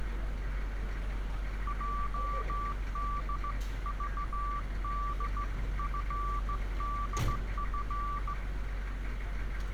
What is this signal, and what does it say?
Morse code (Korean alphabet), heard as a keyed tone, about 16 wpm, 1160 Hz, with street noise. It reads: 흐르는